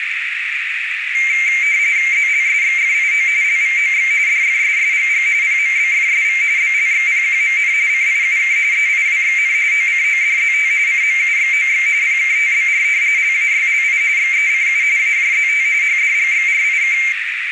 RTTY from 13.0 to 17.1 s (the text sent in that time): LAYLI XECU AJZT HDGXRIK